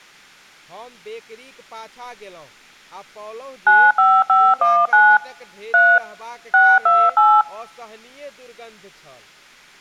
DTMF, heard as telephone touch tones, dialled by machine, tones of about 240 ms, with speech in Maithili. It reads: 95519 3 628